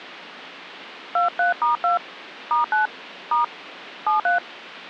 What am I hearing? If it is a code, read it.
DTMF, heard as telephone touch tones, dialled by hand, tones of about 130 ms. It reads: 23*2 *9 * 73